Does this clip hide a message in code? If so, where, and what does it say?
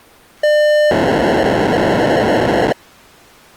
Yes: POCSAG pager data (1200 baud) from 0.4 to 2.7 s, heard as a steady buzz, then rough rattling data.